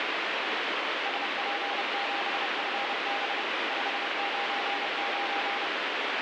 Morse code, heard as a keyed tone, machine-sent, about 30 wpm, 800 Hz, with heavy radio static. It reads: SP7FB 599